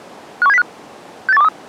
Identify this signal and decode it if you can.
Five-tone selective call (EEA), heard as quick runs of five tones, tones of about 40 ms. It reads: 51705 68123